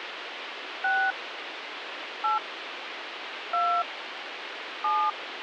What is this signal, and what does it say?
DTMF, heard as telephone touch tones, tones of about 240 ms, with phone line noise. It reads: 6 8 2 7